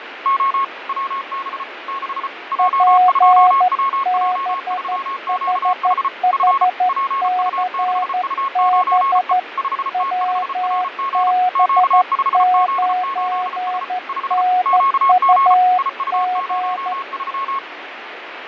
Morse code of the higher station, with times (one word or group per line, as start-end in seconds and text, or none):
0.3-0.6 O
0.9-1.6 WB
1.9-2.3 6
2.5-6.1 J2WJ3QH
6.3-6.6 F
6.9-9.3 PU6U9E
9.6-11.3 5T5RG
11.6-13.8 Q5Z8S
14.1-14.4 5
14.7-15.5 QG
15.8-17.6 IU03